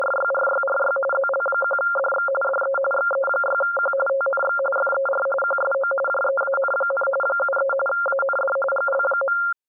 RTTY (45.45 baud, 850 Hz shift), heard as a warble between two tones, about 970 Hz centre. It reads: … ZL1DX DE XE6Q TNX FER QSO JEAN, 73 AND GL.